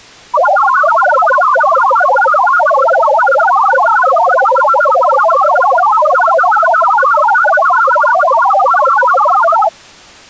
Multi-tone FSK (Olivia or MFSK type), about 1000 Hz wide, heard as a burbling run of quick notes, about 62.5 baud.